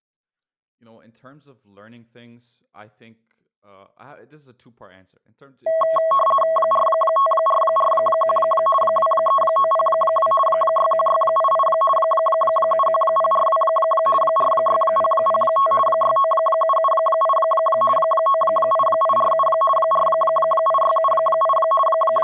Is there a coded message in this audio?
Yes: RTTY (50 baud, 450 Hz shift) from 5.7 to 22.2 s, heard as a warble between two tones, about 870 Hz centre, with speech in English. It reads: 45441 23902 61688 71042 46005 69778 98847 48678 …